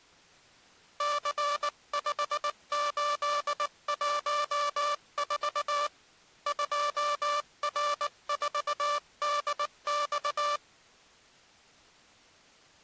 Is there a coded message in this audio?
Yes: Morse code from 0.9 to 10.6 s, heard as a buzzer, hand-sent with a paddle, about 19 wpm. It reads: C5814 2R4DX